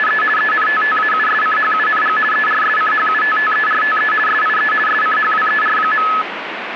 RTTY (50 baud, 450 Hz shift), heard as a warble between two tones, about 1500 Hz centre, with radio static. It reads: … ENTTAUSCHUNG ERSCHUTTERTE SIE SCHWER.